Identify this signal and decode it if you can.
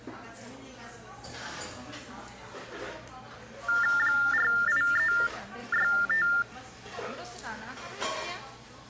TTY/TDD text telephone tones (45.45 baud Baudot), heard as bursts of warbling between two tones, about 400 Hz shift, 1600 Hz centre, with the noise of a cafe. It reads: 48365